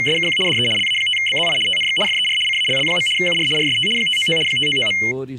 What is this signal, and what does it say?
RTTY (75 baud, 850 Hz shift), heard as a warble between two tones, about 2550 Hz centre. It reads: … DE LA5BZI TNX FER CALL. UR RST 599 599.